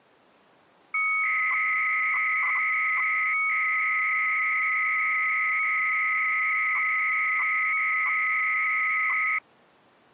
300-baud modem data (Bell 103 tones), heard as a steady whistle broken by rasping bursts, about 300 baud, 200 Hz shift.